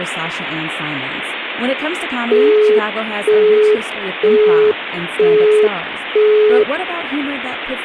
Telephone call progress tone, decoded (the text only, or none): busy tone